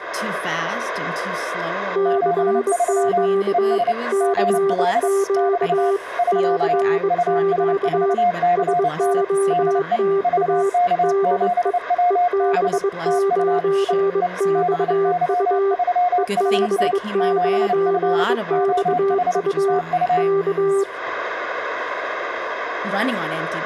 Morse code, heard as two keyed tones. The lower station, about 22 wpm, 390 Hz: CQ CQ CQ SOTA DE EB9XU EB9XU K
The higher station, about 29 wpm, 710 Hz: 73 ES GL <BT> <SK> US4CN DE VK7WB TU E E BY3HT 7F OH TU